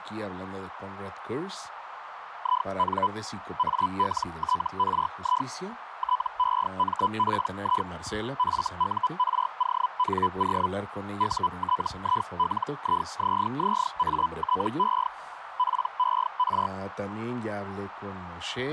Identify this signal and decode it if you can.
Hellschreiber (Feld-Hell, 122.5 baud), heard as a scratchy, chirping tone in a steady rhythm, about 1000 Hz, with radio static, a narrow filter and speech in Spanish. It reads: IN ALTRI TEMPI FURONO UTILIZZATE PER